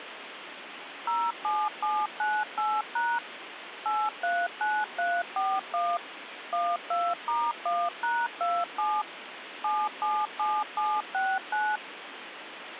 DTMF, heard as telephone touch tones, dialled by machine, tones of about 240 ms, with phone line noise. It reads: 07798# 839341 12*1#27 777769